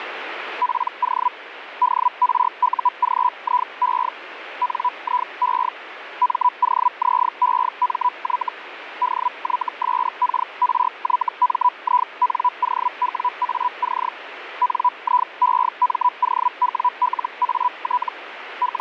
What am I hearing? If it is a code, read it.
Hellschreiber (Feld-Hell, 122.5 baud), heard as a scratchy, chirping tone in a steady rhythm, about 990 Hz, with radio static. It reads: PO DRUGIE NIE MOZEMY DYSKRYMINOWAC NIEMOWLAT …